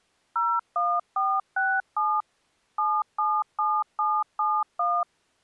DTMF, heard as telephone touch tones, dialled by machine, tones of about 240 ms. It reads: 01467 777771